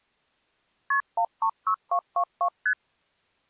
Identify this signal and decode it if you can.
Multi-frequency trunk signalling (R1, as on North American trunks), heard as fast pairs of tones, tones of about 80 ms. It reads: KP 136222 ST